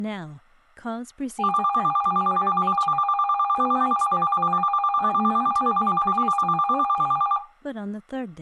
A tone that alternates evenly between two pitches, with speech in English. There is no code.